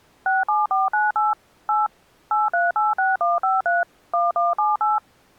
DTMF, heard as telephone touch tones, dialled by machine, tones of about 170 ms. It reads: 67498 8 8386153 1178